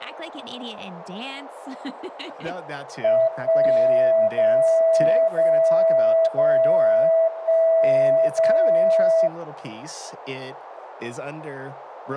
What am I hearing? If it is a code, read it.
Radio time signal (DCF77), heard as a tone whose level steps once a second, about 650 Hz, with radio static and speech in English. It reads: 1 0 0 0 1 0